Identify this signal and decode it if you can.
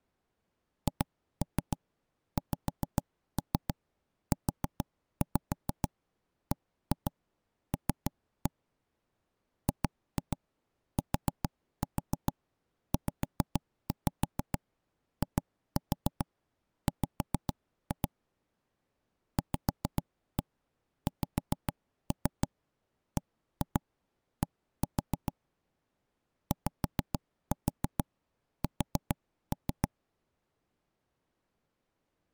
Tap code, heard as knocks on wood, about 6 knocks a second. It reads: HXUBL GTZIW VXBD YS